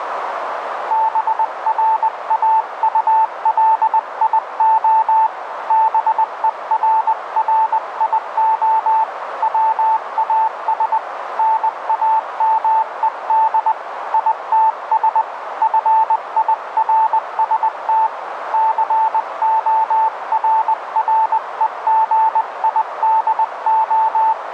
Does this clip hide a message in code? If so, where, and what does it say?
Yes: Morse code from 0.8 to 24.5 s, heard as a keyed tone, hand-sent with a paddle, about 20 wpm, 880 Hz, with radio static and a narrow filter. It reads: BRAULIO BERRIO WAS NAMED ITS FIRST …